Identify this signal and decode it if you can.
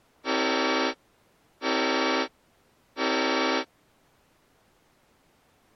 Train horn signal, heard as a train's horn. 3 short. On North American railways: when stopped, the train will back up.